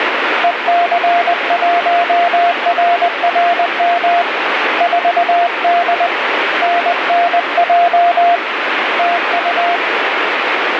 Morse code, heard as a keyed tone, hand-sent with a paddle, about 20 wpm, 700 Hz, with radio static. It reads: EC1RRM 4D NNJ TU